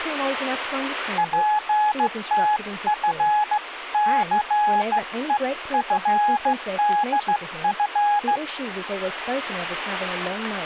Morse code (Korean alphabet), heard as a keyed tone, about 15 wpm, 840 Hz, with speech in English. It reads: 전차는